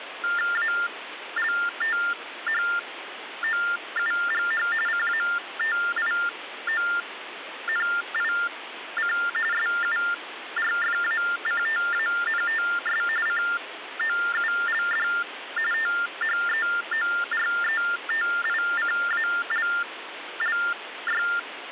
TTY/TDD text telephone tones (45.45 baud Baudot), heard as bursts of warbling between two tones, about 400 Hz shift, 1600 Hz centre, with phone line noise. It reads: ALTHOUGH CATIONIC SURFACTANTS COULD THEORETICALLY